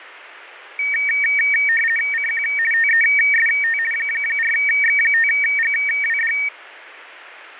RTTY (50 baud, 450 Hz shift), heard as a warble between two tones, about 2050 Hz centre. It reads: CQ TEST 4X5GWD